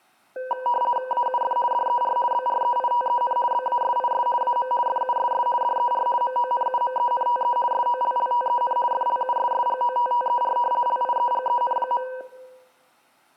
RTTY (50 baud, 450 Hz shift), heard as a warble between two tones, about 740 Hz centre. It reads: AUF DER BREITEN BASIS AM FUSS DER MONUMENTE SOLLTEN FLUSSGOTTER LIEGEN.